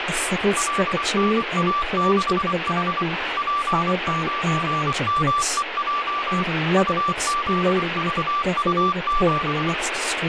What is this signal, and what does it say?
Morse code, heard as a keyed tone, machine-sent, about 24 wpm, 1170 Hz, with radio static and speech in English. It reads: LNA6H P9MEJ UZVU7